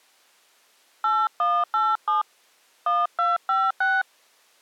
DTMF, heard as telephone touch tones, dialled by hand, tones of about 190 ms. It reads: 8187 1256